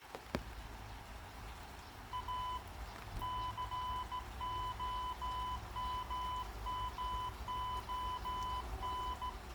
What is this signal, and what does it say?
Morse code, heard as a keyed tone, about 15 wpm, 1000 Hz, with the noise of a park. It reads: A COMMON